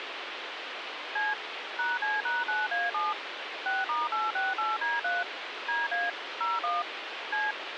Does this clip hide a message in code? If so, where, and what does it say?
Yes: DTMF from 1.2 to 7.5 s, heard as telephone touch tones, dialled by machine, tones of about 190 ms, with phone line noise. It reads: C #C#9A7 6*868D3 DA 01 C